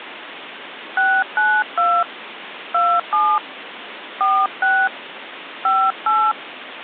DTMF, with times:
1.0-2.0 692
2.7-3.4 27
4.2-4.9 46
5.7-6.3 58

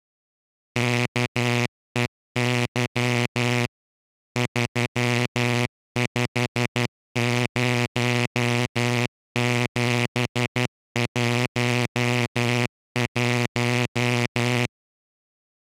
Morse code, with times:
0.8-3.7 KEY
4.4-14.7 350711

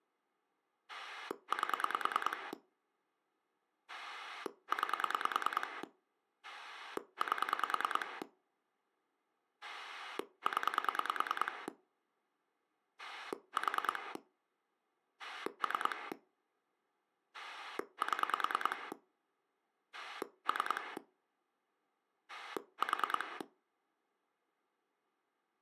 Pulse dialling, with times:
0.9-2.5 8
3.9-5.8 9
6.4-8.2 8
9.6-11.7 0
13.0-14.2 4
15.2-16.1 3
17.3-18.9 7
19.9-21.0 3
22.3-23.4 4

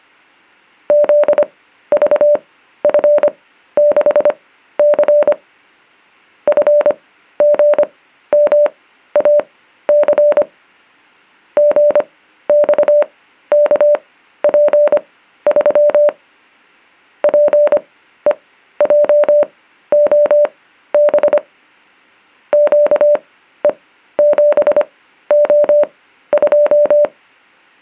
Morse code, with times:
0.9-5.3 ZVF6C
6.5-10.4 FGMAC
11.6-16.1 GXKP3
17.2-21.4 PEJOB
22.5-27.0 QE7O2

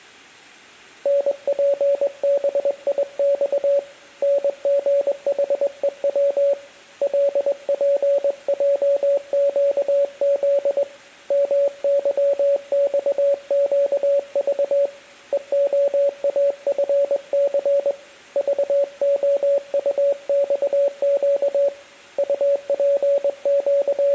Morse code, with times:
1.1-3.8 NPBIX
4.2-6.5 NGHEW
7.0-10.8 LPJQZ
11.3-14.9 MYXQV
15.3-17.9 EOAFC
18.4-21.7 VOUXQ
22.2-24.1 …

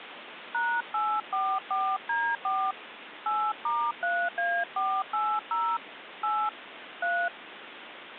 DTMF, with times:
0.5-2.7 #844D4
3.3-5.8 8*3A480
6.2-6.5 8
7.0-7.3 3

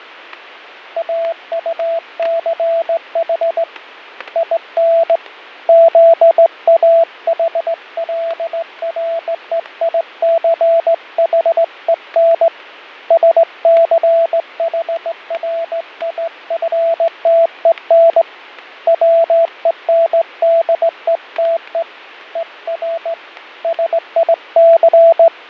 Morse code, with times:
1.0-3.6 AUCH
4.4-5.2 IN
5.7-12.5 ZAHLREICHEN
13.1-18.2 SCHRIFTEN
18.9-21.8 WENDETE
22.4-23.1 ER
23.6-25.5 …

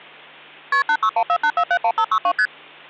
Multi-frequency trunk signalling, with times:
0.7-0.8 KP
0.9-2.3 86148471562
2.4-2.5 ST

